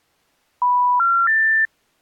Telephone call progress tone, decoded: special information tone

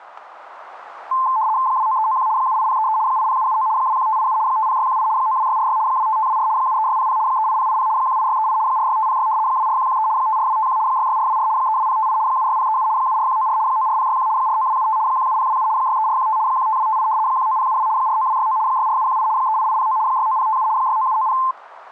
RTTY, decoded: 29391 78033 80779 21587 50618 92646 25524 73600 38080 18638 46506 24113 54251 66424 32058 76037 74194 94061 49275 17027 63415 15258 19072 49269 64718 38809 69057 69790

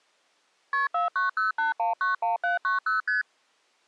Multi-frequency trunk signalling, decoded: KP 4908191790 ST

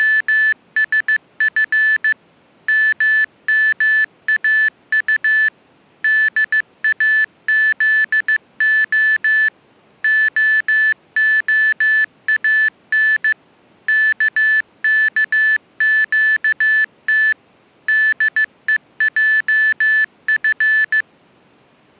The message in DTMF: none

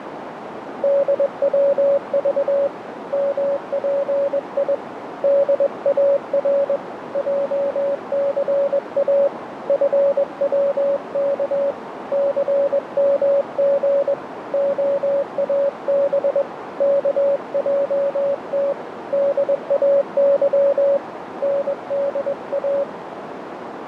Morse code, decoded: DWV MPI DAR JCA FWK CMG OAB KJT DAY NDA

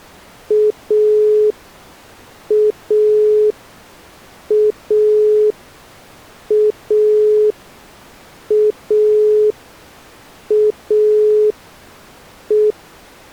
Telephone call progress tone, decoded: dial tone

